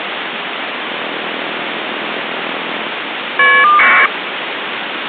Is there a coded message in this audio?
Yes: caller ID data burst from 0.9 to 4.1 s, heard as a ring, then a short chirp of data, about 1200 baud, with phone line noise.